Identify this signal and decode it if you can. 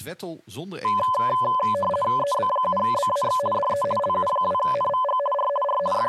RTTY (50 baud, 450 Hz shift), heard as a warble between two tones, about 800 Hz centre, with speech in Dutch. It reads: EB7BAX DE LU2NVG R R …